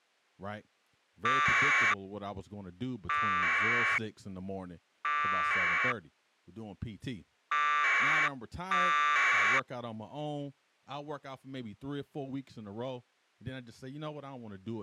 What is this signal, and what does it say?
Packet radio (AX.25, as in APRS), 1200 baud, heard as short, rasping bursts, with speech in English.